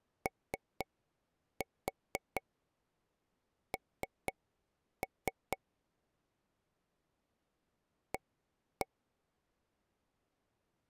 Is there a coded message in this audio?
Yes: tap code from 0.3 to 8.9 s, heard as taps on a table, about 4 knocks a second. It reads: ON A